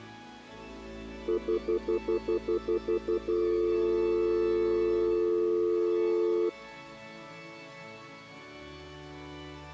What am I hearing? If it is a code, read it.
Telephone call progress tone (North American plan), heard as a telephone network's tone, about 350, 440 Hz, 0.1 s on and 0.1 s off. Stutter dial tone.